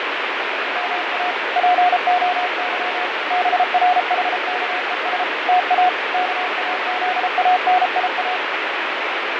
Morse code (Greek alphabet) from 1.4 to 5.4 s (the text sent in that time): ΠΟΥ ΒΡΗΚΕΣ